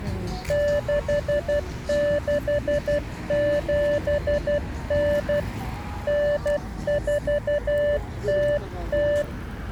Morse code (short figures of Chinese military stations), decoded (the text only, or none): 6679 9400